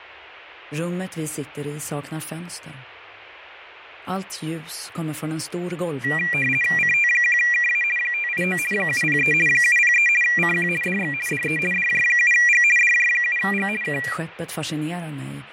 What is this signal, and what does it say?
RTTY (50 baud, 450 Hz shift), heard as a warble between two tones, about 2150 Hz centre, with radio static and fading. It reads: CT1KA 589 703 703 CQ DX DE DJ7G DJ7G K